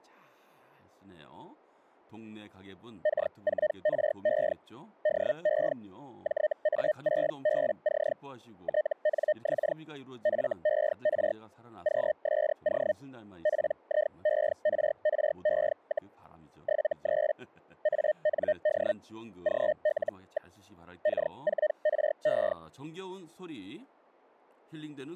Hellschreiber (Feld-Hell, 122.5 baud), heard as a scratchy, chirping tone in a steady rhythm, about 610 Hz, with speech in Korean. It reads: K4RE DE JA6BC TNX FER QSO PIERRE, 73 AND GL. K4RE